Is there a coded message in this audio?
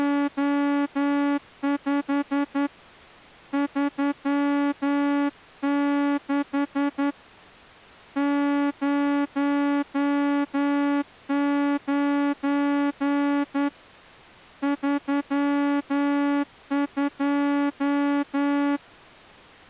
Yes: Morse code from 0.0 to 18.8 s, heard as a horn, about 10 wpm. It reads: … 36 09 32